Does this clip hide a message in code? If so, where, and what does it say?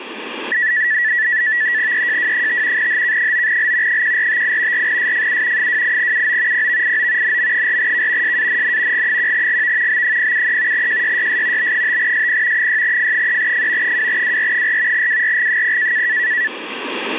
Yes: NAVTEX (SITOR-B), 100 baud, 170 Hz shift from 0.5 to 16.5 s, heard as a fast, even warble, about 1850 Hz centre, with radio static. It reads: EJW5 HK9L 1458 4SFU 28UO PVIO NM4K SANN G1GV B073 JYYS B5SP 6F3F 2WR4 WRG0